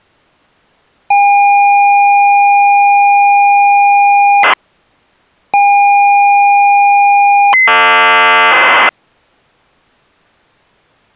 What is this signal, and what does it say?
ZX Spectrum tape loading, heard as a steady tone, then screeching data.